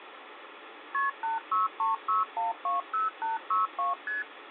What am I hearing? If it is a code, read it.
Multi-frequency trunk signalling (R1, as on North American trunks), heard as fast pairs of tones, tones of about 150 ms, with phone line noise. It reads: KP 8636120862 ST